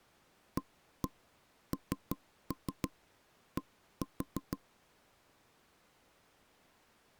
Tap code, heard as knocks on wood, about 6 knocks a second. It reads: AND